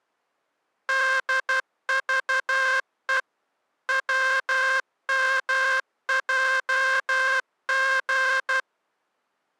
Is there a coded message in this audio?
Yes: Morse code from 0.8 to 8.7 s, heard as a buzzer, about 12 wpm. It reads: DVE WMJG